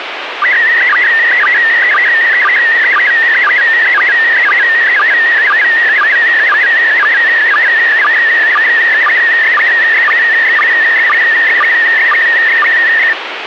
SSTV (slow-scan television), PD 120, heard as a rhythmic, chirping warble, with radio static.